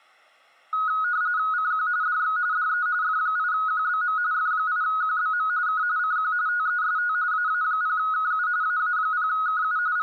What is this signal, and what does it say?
RTTY (45.45 baud, 170 Hz shift), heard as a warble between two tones, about 1360 Hz centre, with room echo. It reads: CQ DX DE F8QBM F8QBM K CQ TEST AA0KU AA0KU …